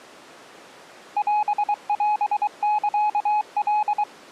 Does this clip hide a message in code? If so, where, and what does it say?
Yes: Morse code (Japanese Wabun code) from 1.1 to 4.1 s, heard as a keyed tone, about 23 wpm, 840 Hz. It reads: オオサカ